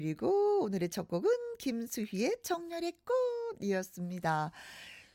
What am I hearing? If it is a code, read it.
Speech in Korean. There is no code.